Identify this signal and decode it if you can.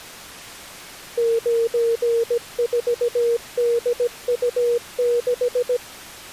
Morse code, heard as a keyed tone, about 17 wpm, 470 Hz. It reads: 94DU6